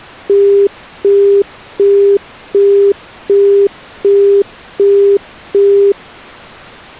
Telephone call progress tone (as in the UK, Australia and similar networks), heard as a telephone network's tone, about 400 Hz, 0.375 s on and 0.375 s off. Busy tone.